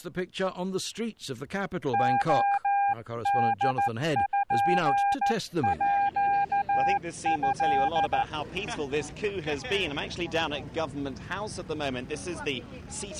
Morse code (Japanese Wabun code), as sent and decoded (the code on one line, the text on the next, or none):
--- -.. ..--. .--.- ..-..
レポート